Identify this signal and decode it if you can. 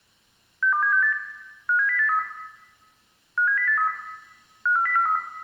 Five-tone selective call (CCIR), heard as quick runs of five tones, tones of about 100 ms, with room echo. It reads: 62768 57083 57083 54043